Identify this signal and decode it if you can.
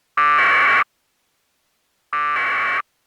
Packet radio (AX.25, as in APRS), 1200 baud, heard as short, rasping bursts.